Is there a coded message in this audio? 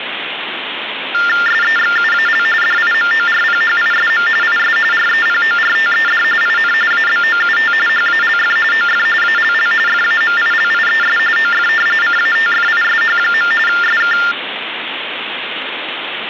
Yes: TTY/TDD text telephone tones (45.45 baud Baudot) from 1.1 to 14.3 s, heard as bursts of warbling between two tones, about 400 Hz shift, 1600 Hz centre, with phone line noise. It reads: SEXUAL DIMORPHISM IS REPORTED IN ABOUT HALF OF ALL FAMILIES OF CATFISH. SK